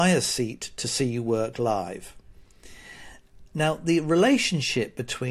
Speech in English. There is no code.